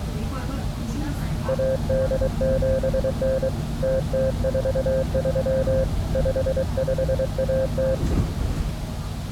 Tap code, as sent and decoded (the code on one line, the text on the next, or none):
none